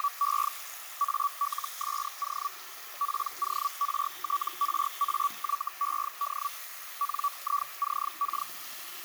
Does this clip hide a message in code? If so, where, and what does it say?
Yes: Hellschreiber (Feld-Hell, 122.5 baud) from 0.0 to 8.5 s, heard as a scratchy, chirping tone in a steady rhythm, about 1140 Hz, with radio static, a narrow filter and the noise of a restroom. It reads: … ALSO PORTRAYED NICK